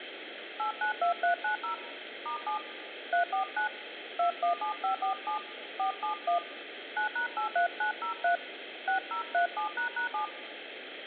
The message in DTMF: 892390 *7 349 217547 471 9#83903 6037##7

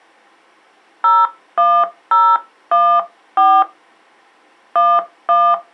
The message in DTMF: 01014 11

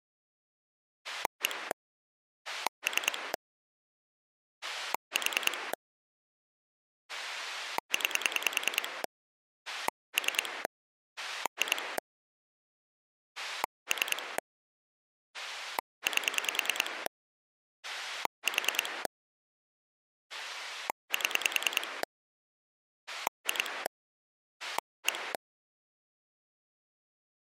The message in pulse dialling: 1 3 4 9 3 2 3 8 4 7 2 1

